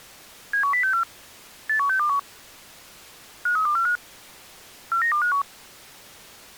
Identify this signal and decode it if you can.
Five-tone selective call (CCIR), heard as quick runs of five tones, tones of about 100 ms. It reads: 71064 81621 53245 49251